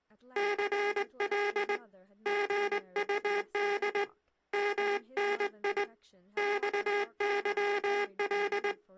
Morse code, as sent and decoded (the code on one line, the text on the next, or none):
-.-. .-.. / --. ..- -.. / -- -. .. / -..- -.-- .-..
CL GUD MNI XYL